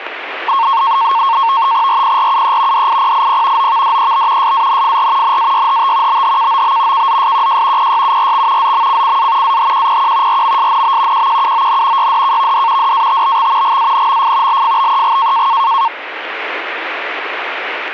NAVTEX (SITOR-B), 100 baud, 170 Hz shift, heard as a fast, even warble, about 1000 Hz centre. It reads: RPRUE DIPIP OVDEB SANFR NAYHT BHKOB KZSQJ PYURX ZMCCA AHQPQ RMSNB QQUON YDKVD DATBX GANMF LFBEG